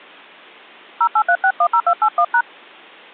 DTMF, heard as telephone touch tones, dialled by hand, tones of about 70 ms. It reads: 083610281#